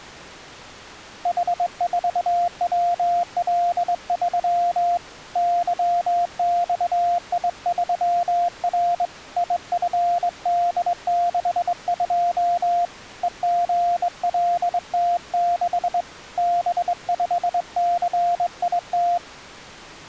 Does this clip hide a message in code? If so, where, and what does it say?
Yes: Morse code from 1.2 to 19.2 s, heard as a keyed tone, hand-sent with a straight key, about 22 wpm, 700 Hz. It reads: H4WL3 YXI3R IFD62 EGLT6 B5CIT